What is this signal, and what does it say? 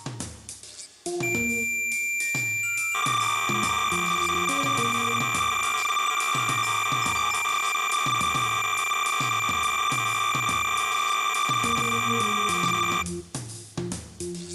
Cassette data (Kansas City type), 300 baud, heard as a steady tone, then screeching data.